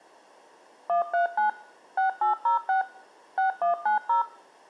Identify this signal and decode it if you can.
DTMF, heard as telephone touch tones, dialled by machine, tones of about 120 ms. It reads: 139 6806 6190